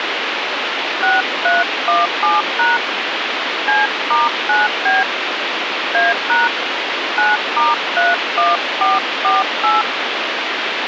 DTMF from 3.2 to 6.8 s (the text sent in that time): C*9B A#